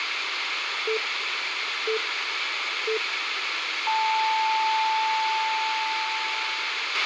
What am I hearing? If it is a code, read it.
Radio time signal (three low pips and a long one an octave up, as on NHK), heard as pips, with radio hiss and a squelch burst at the end.